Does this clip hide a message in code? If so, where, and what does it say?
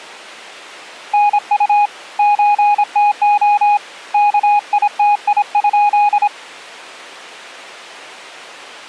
Yes: Morse code (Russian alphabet) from 1.1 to 6.3 s, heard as a keyed tone, hand-sent with a paddle, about 26 wpm, 830 Hz. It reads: НУ ЧТО КИТИ?